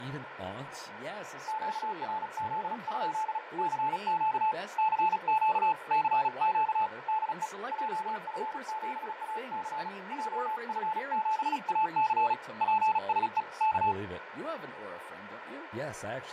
Morse code, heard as a keyed tone, hand-sent with a paddle, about 36 wpm, 870 Hz, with radio static, fading, a narrow filter and speech in English. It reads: QRZ? CQ CQ CQ DE JF7AC JF7AC PSE K